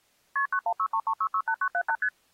Multi-frequency trunk signalling (R1, as on North American trunks), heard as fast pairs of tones, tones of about 70 ms. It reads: KP 91633668978 ST